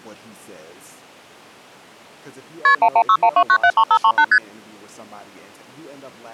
Multi-frequency trunk signalling (R1, as on North American trunks), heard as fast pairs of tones, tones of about 70 ms, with speech in English. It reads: KP 11612973538 ST